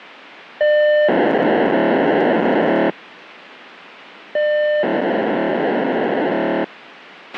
POCSAG pager data (1200 baud), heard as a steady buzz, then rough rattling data, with radio hiss and a squelch burst at the end.